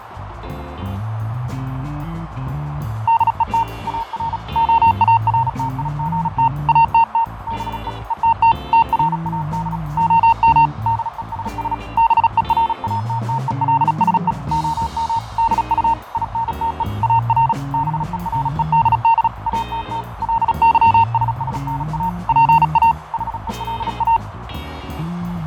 Morse code, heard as a keyed tone, hand-sent with a paddle, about 36 wpm, 920 Hz, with radio static, fading and a narrow filter. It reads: DET AR OARTIGT ATT BE ETT TRAD OM DESS BERATTELSE OM DU INTE AR BEREDD ATT LYSSNA PA HELA